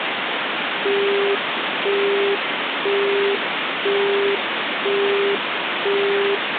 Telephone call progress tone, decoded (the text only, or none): busy tone